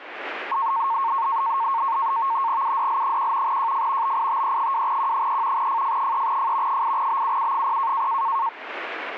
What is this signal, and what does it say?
NAVTEX (SITOR-B), 100 baud, 170 Hz shift, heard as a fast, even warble, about 1000 Hz centre. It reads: UDL1 JF BITE2Q3 FF3F 8BUU0